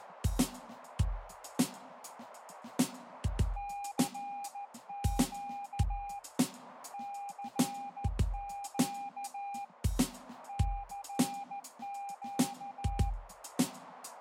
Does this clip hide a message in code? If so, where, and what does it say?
Yes: Morse code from 3.5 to 13.2 s, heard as a keyed tone, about 14 wpm, 800 Hz, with radio static and a narrow filter. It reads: CQ CQ CQ